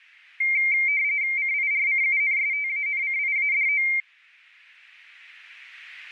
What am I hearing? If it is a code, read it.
RTTY (45.45 baud, 170 Hz shift), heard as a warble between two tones, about 2200 Hz centre. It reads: CIRCUNSTANCIADO